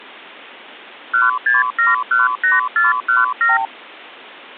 Multi-frequency trunk signalling (R2, with the far end's replies), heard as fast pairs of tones, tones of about 160 ms. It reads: 16718417